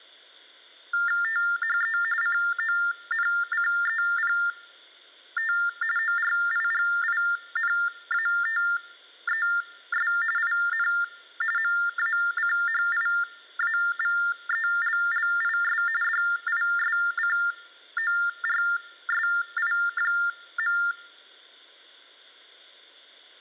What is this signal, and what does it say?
TTY/TDD text telephone tones (45.45 baud Baudot), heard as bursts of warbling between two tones, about 400 Hz shift, 1600 Hz centre. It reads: THE CONCEPT ORIGINATES IN MACHIAVELLIS DISCORSI.